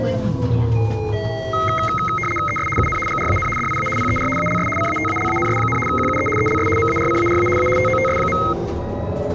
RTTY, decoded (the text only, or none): ES UN GRAN DIA PER ALS CATALANS, QUE ELS MARCARA A TOTS.